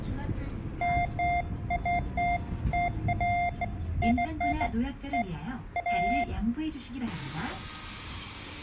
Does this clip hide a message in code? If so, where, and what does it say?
No, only beeps of irregular length, with room echo and the noise inside a bus.